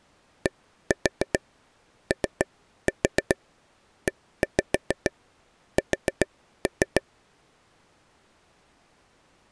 Tap code, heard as taps on a table, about 7 knocks a second. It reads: DOES